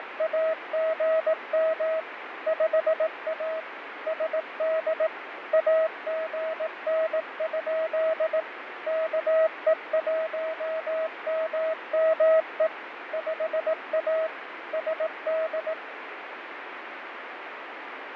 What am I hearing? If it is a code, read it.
Morse code, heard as a keyed tone, machine-sent, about 18 wpm, 640 Hz, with radio static and fading. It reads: … 5A SD AGN? KE1MME 5A SD